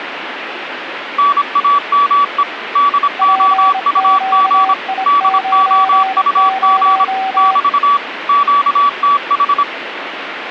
Morse code, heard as two keyed tones, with radio static. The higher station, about 26 wpm, 1140 Hz: NAME DOUG DOUG <BT> QTH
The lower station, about 26 wpm, 770 Hz: PQI90